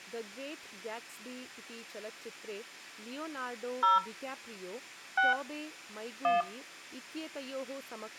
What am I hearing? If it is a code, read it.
DTMF, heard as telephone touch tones, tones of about 160 ms, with speech in Sanskrit. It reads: 0 6 1